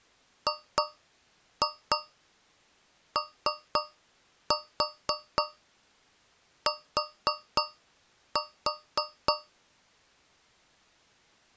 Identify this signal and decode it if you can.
Tap code, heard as taps on a metal pipe, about 3 knocks a second. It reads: GOT